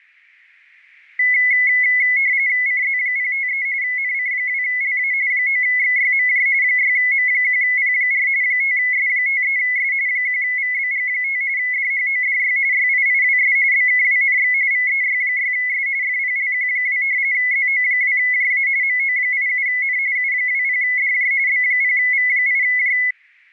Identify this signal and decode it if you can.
RTTY (45.45 baud, 170 Hz shift), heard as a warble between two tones, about 2100 Hz centre. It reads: CZ053 NC2LA 9XYMJ 6M1P4 5S53S 1VBG5 DHODY YIIWS BKWNX VEY6S FPLQ2 ZO2JA MO87N U20DJ B0V8J